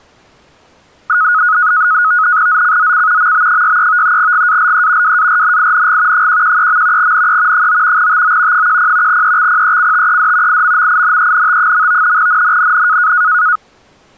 NAVTEX (SITOR-B), 100 baud, 170 Hz shift, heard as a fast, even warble, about 1360 Hz centre. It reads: ZCZC MB63 GALE WARNING 113. NE 9 TO 10 EXPECTED IMMINENT. NNNN